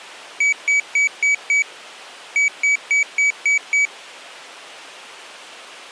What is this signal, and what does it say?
Beep code, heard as a piezo beeper, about 2300 Hz. 5-6.